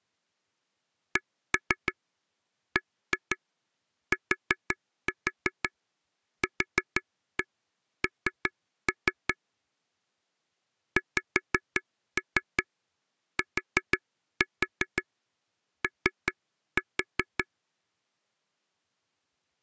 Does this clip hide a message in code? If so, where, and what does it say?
Yes: tap code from 1.2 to 17.5 s, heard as taps on a table, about 5 knocks a second. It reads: CBTQN XTO